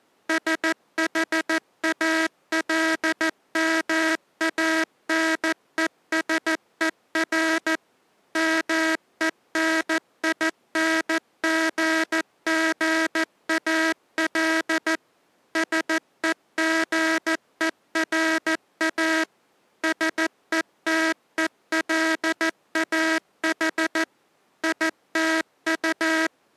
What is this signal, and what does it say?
Morse code, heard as a buzzer, machine-sent, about 14 wpm. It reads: SHALMANESER MENINGGAL SEGERA SETELAH ITU